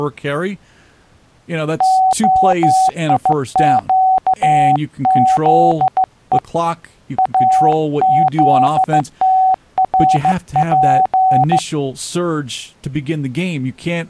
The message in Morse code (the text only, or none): OIQZE AZTRP